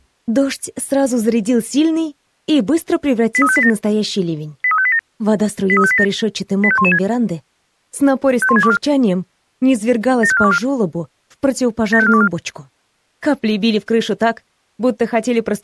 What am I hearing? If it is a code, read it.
Five-tone selective call (ZVEI), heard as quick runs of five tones, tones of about 70 ms. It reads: 83587 83587 83587 85116 51624 75424 75424